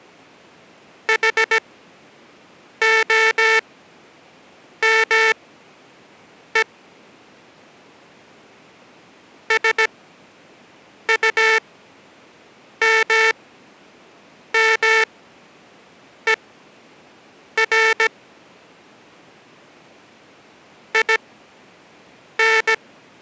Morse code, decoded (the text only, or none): HOME SUMMER IN